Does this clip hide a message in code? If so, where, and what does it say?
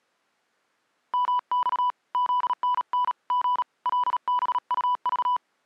Yes: Morse code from 1.1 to 5.4 s, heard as a keyed tone, hand-sent with a paddle, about 37 wpm, 990 Hz. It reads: MX ZNN G LBUV